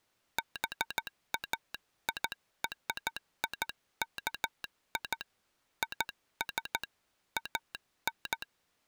Morse code (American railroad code), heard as a telegraph sounder, hand-sent with a straight key. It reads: BAIRIKI IS AN